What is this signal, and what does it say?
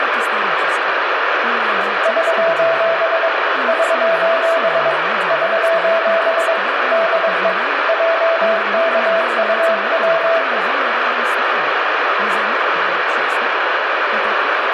Morse code, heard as a keyed tone, hand-sent with a paddle, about 22 wpm, 660 Hz, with radio static and room echo. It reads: <SOS> <SOS> <SOS> DE JKUW